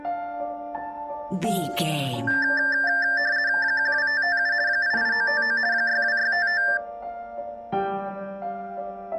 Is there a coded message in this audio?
Yes: RTTY (50 baud, 170 Hz shift) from 2.3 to 6.8 s, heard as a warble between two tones, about 1700 Hz centre. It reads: 12557 88959 62655